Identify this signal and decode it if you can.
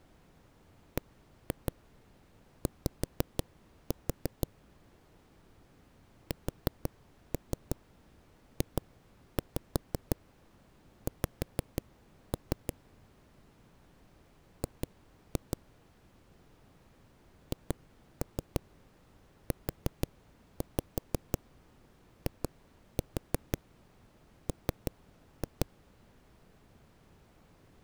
Tap code, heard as knocks on a wall, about 6 knocks a second. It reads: BY SJX G HUIM